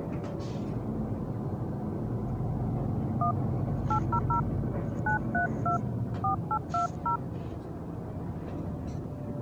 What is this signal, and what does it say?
DTMF, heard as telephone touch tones, dialled by hand, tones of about 100 ms, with the noise inside a bus. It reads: 1 800 932 4820